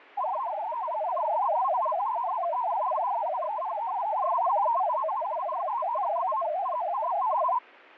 Multi-tone FSK (Olivia or MFSK type), about 500 Hz wide, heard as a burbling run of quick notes, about 62.5 baud.